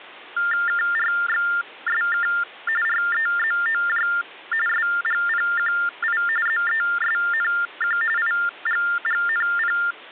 TTY/TDD text telephone tones (45.45 baud Baudot), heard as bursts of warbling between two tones, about 400 Hz shift, 1600 Hz centre, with hum. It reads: KRXSK REZOJ SGPQI ZESNQ IGGNP